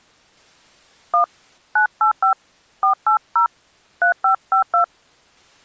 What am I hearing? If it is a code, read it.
DTMF, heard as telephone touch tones, dialled by hand, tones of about 110 ms. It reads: 1 985 480 3552